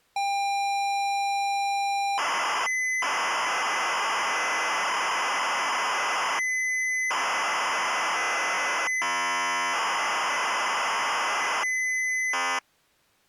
ZX Spectrum tape loading, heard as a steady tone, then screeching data.